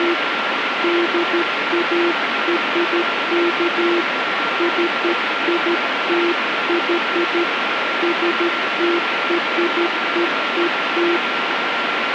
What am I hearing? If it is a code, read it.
Morse code (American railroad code), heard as a keyed tone, hand-sent with a straight key, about 340 Hz, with radio static and a steady whistle near 1370 Hz. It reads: … DARK CITY STREET